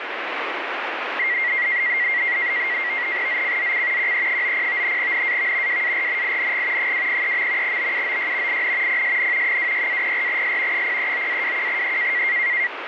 NAVTEX (SITOR-B), 100 baud, 170 Hz shift, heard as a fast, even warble, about 2050 Hz centre, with radio static. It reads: ZCZC QE90 NAV WARNING 203. BUOY IN PSN 26-04S 039-21E